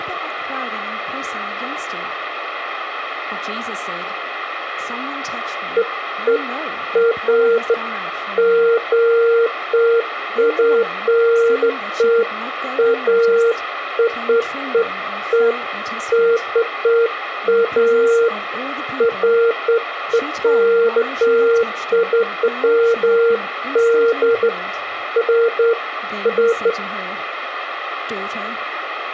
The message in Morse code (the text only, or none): none